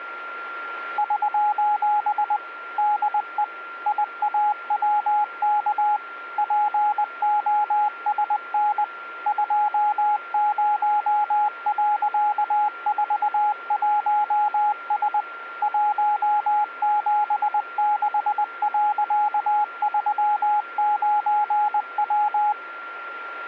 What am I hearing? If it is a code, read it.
Morse code, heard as a keyed tone, machine-sent, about 20 wpm, 840 Hz, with a steady whistle near 1380 Hz. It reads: <SOS> DE IAWK POSN 20.41S 176.39W